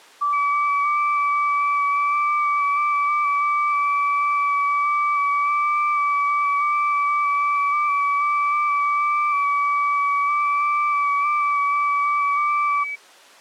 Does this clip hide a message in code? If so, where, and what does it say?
Yes: FT8 (several signals at once) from 0.2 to 13.0 s, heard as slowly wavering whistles, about 6.25 baud.